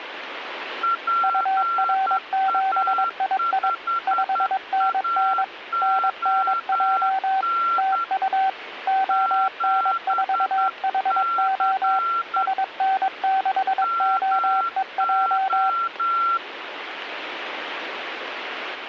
Morse code, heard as two keyed tones, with radio static. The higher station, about 10 wpm, 1360 Hz: PA5AON 7C MO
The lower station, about 22 wpm, 770 Hz: UR7II 5NN NNJ TU ON4HO SN6OEJ